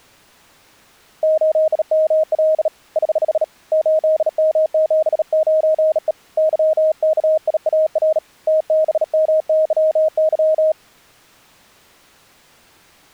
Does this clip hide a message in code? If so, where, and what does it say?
Yes: Morse code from 1.2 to 10.8 s, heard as a keyed tone, hand-sent with a bug key, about 37 wpm, 630 Hz. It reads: 8ML <HH> 8M79E YKIAR TBMYY